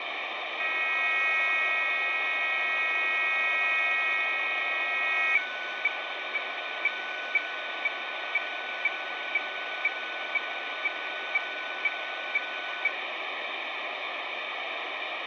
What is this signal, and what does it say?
Weather fax (radiofax), 120 lines a minute, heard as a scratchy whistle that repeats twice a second, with heavy radio static.